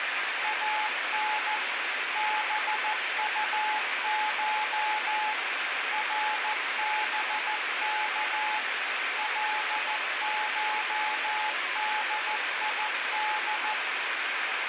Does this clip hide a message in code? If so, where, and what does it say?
Yes: Morse code (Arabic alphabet) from 0.4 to 13.8 s, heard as a keyed tone, machine-sent, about 14 wpm, 860 Hz, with heavy radio static and room echo. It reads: ان بطش ربك لشديد